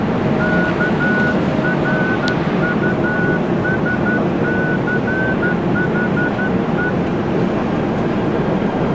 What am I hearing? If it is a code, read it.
Morse code, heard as a whistle, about 12 wpm, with the noise inside a subway train. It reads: KRUSCHE